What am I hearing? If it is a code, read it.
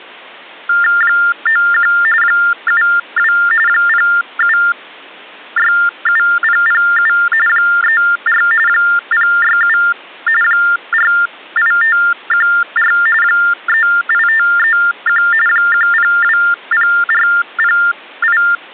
TTY/TDD text telephone tones (45.45 baud Baudot), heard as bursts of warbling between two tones, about 400 Hz shift, 1600 Hz centre. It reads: 91 72 0767007 34 067 48514 38531 1020408